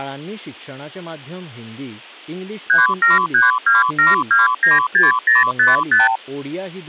Multi-frequency trunk signalling (R2, with the far end's replies), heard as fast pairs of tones, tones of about 160 ms, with speech in Goan Konkani. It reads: 37327296055